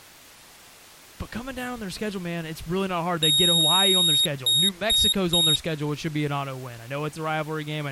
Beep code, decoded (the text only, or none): 1 long, 3 short